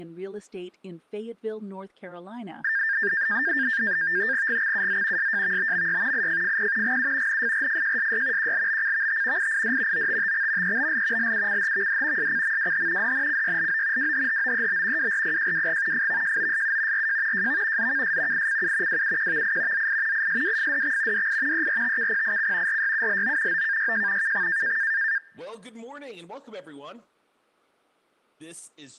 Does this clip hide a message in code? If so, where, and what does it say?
Yes: NAVTEX (SITOR-B), 100 baud, 170 Hz shift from 2.6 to 25.2 s, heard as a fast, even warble, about 1700 Hz centre, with speech in English. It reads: GXUZ SJVBMY IFFP GU NFRFJSY QLBCVT IID OTTX EBL LUCHVD SCMWH DNCYLO WHHOEB WRPJWG FVJOSU RJ JV ZKS ICU WUQVI ZI ISWFDX DI ERTKPIC RYULO OKYJ KX